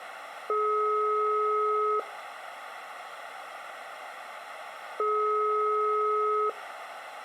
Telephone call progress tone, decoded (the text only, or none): ringback tone